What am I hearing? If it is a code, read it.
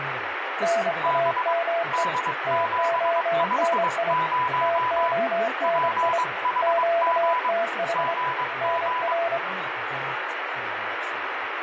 Morse code, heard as two keyed tones, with radio static and speech in English. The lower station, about 25 wpm, 680 Hz: NAME TONI TONI QTH NR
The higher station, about 22 wpm, 1000 Hz: B D750 PHG GG